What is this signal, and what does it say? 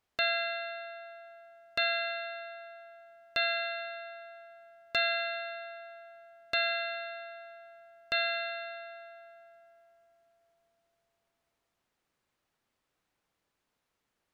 Clock strike, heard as a bell. 6. Six o'clock.